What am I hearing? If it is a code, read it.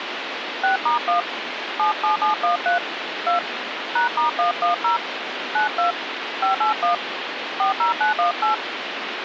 DTMF, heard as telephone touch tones, dialled by hand, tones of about 130 ms, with phone line noise. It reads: 6*1 77713 2 #*110 92 581 40918